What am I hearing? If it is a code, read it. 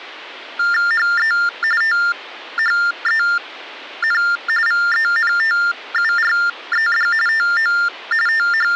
TTY/TDD text telephone tones (45.45 baud Baudot), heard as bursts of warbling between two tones, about 400 Hz shift, 1600 Hz centre. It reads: HE THEN VENTURED TO …